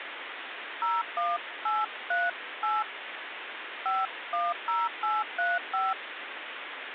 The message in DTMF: 01838 510835

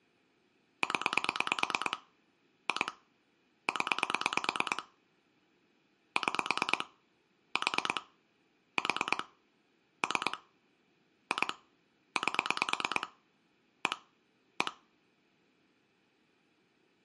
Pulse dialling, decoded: 0 2 0 6 4 4 3 2 8 1 1

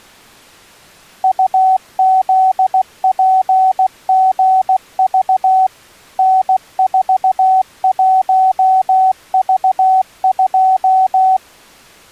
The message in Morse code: UZPGV N41V2

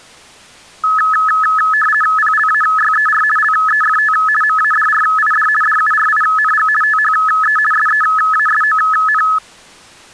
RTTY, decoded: PLAYER LEFT MADRID DURING THE SEASON

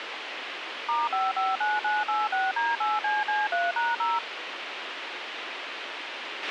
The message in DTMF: *559986D8CC3#0

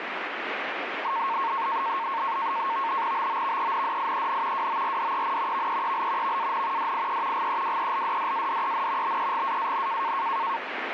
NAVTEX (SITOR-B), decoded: BOVENDIEN WORDEN VEEL VAN DIE GEWELDDADEN BEGAAN

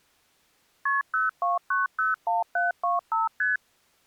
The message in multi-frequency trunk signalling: KP 02901725 ST

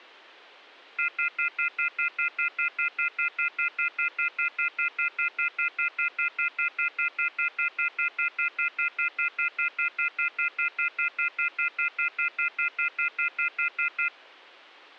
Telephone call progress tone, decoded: off-hook warning tone

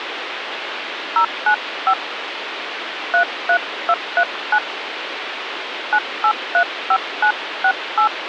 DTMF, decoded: 095 33239 9835968

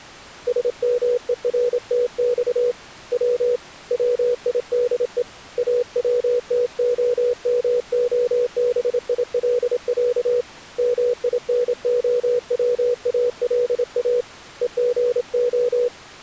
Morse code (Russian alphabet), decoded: СМЕРТЬ В ВИДЕ АВТОМОБИЛЯ МИНОВАЛА ЕГО

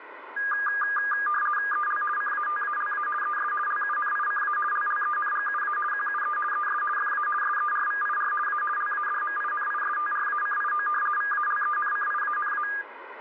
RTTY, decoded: EL CATALA ES LUNICA LLENGUA QUE ES FA SERVIR A LADMINISTRACIO VALENCIANA

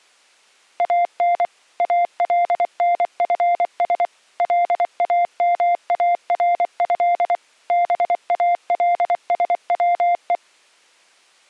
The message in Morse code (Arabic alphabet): ان النفس لاماره بالسوء

